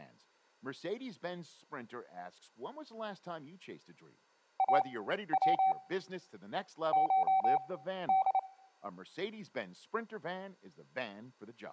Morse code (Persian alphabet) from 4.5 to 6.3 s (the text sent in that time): او